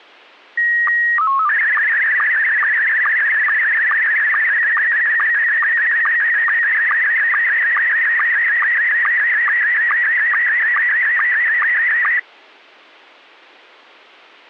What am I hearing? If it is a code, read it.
SSTV (slow-scan television), Scottie S1, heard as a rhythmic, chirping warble.